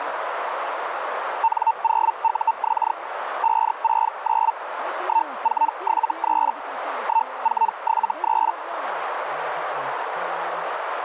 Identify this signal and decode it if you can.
Hellschreiber (Feld-Hell, 122.5 baud), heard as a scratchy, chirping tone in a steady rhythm, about 900 Hz, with radio static and a narrow filter. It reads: N0UX 569 1473 1473